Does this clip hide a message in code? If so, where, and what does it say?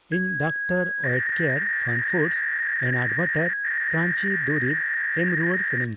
Yes: 300-baud modem data (V.21 tones) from 0.1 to 5.8 s, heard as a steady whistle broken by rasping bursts, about 300 baud, 200 Hz shift, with speech in Santali.